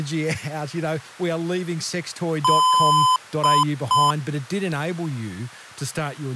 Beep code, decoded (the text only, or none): 1 long, 2 short